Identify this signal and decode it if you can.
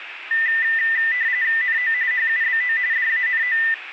RTTY (45.45 baud, 170 Hz shift), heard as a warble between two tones, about 1900 Hz centre, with radio static. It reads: NO HUBO DANO